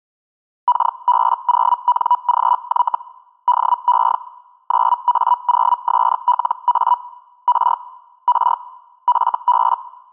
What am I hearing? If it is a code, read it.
Hellschreiber (Feld-Hell, 122.5 baud), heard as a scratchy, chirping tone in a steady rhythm, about 980 Hz. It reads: KB0NGY DE 9A0SLA R R FB